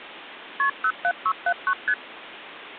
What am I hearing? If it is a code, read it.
Multi-frequency trunk signalling (R1, as on North American trunks), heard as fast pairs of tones, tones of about 60 ms, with phone line noise. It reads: KP 07679 ST